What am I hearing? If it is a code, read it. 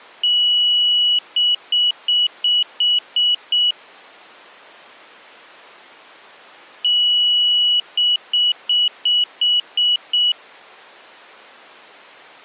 Beep code, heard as a piezo beeper, played twice, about 2950 Hz. 1 long, 7 short.